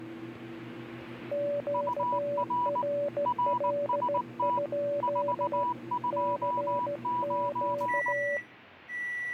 Morse code, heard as two keyed tones, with kitchen noise. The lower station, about 15 wpm, 580 Hz: QRL? CQ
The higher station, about 19 wpm, 980 Hz: UR RST 429